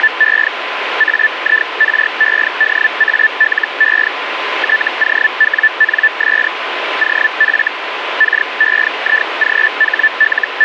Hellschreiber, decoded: … AIREDALE TOWNS OF …

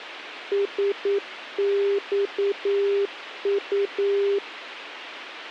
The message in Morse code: SXU

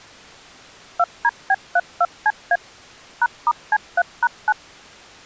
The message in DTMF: 2DB32CA #*C3#9

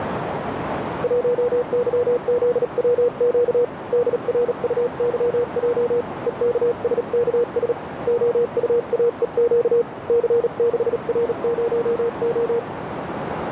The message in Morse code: 1YZWQ DRUYJ EKSKS OUAEQ C6R0O

